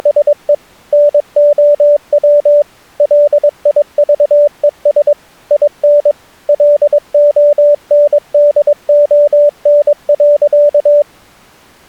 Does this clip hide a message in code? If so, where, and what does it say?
Yes: Morse code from 0.0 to 11.1 s, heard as a keyed tone, machine-sent, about 22 wpm, 590 Hz. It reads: … NOW LIVES IN LONDON.